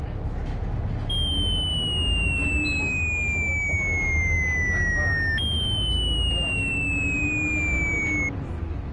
A tone that sweeps in pitch again and again, with the noise inside a bus. There is no code.